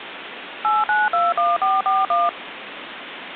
DTMF, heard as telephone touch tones, dialled by machine, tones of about 190 ms, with phone line noise. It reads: 8921441